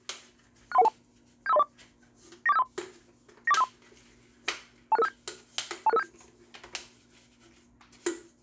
Five-tone selective call (EIA), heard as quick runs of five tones, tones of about 30 ms, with kitchen noise. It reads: 63112 75304 94753 94753 26657 26657